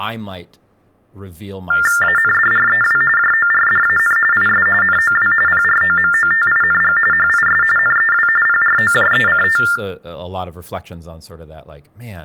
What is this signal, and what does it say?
TTY/TDD text telephone tones (45.45 baud Baudot), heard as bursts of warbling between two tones, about 400 Hz shift, 1600 Hz centre, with room echo and speech in English. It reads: ANDREW JORDAN IS NOW PROMOTING HIS NEW PROJECT